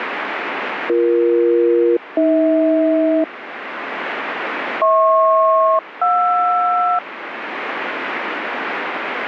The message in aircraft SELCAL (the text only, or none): BE-AH HP-JR